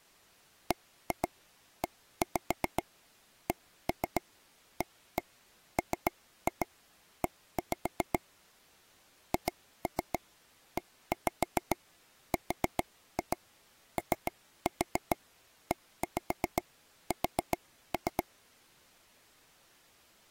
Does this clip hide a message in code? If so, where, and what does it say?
Yes: tap code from 0.7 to 18.2 s, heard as taps on a table, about 7 knocks a second. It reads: BECAME HEROES